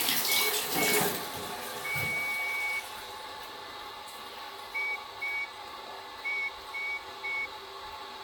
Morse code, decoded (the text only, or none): IT IS